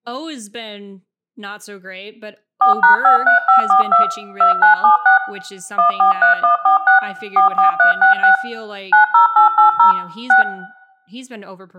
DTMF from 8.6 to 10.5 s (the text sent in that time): 90880 6